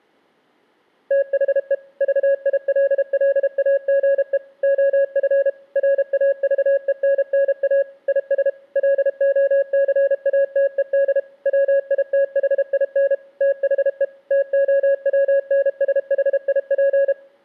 Morse code, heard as a keyed tone, machine-sent, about 32 wpm, 550 Hz. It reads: THE VILLAGE OF RAVENNA IS LOCATED WITHIN THE TOWNSHIP